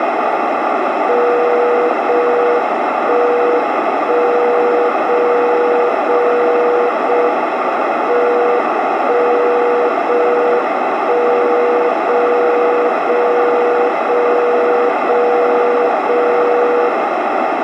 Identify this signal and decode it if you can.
Radio time signal (JJY), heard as a tone whose level steps once a second, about 480 Hz, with radio static and a narrow filter. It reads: 0 1 1 0 0 0 M 1 0 1 0 0 0 0 0 0